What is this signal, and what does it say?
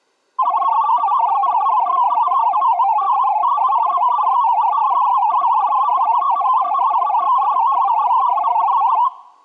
Multi-tone FSK (Olivia or MFSK type), about 500 Hz wide, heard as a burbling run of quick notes, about 62.5 baud.